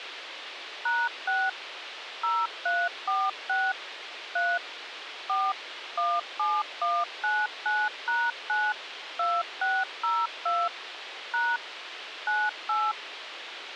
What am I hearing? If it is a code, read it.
DTMF, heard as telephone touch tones, dialled by machine, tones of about 230 ms, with radio hiss. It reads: #6 0346 3 4 17199#9 2602 # 98